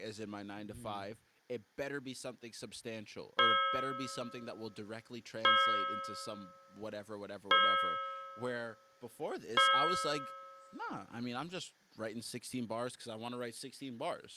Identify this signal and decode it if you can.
Clock strike, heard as a bell, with room echo and speech in English. 4. Four o'clock.